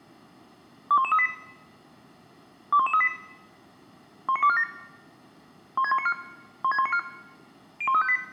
Five-tone selective call (ZVEI), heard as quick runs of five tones, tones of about 70 ms, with room echo. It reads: 21138 21138 19247 16194 16194 01358